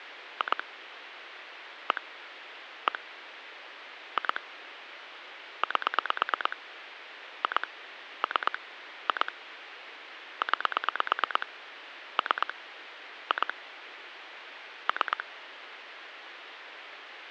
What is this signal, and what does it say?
Pulse dialling, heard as clicks on a phone line, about 9 pulses a second, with phone line noise. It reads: 2 1 1 2 8 2 3 2 9 3 2 3